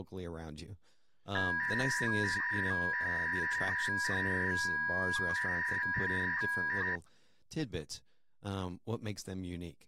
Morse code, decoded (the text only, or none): none